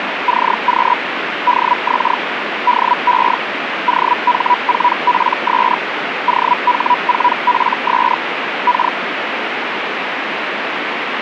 Hellschreiber (Feld-Hell, 122.5 baud), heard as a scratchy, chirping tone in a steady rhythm, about 980 Hz, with radio static. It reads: CQ DX DE OH4PS OH4PS K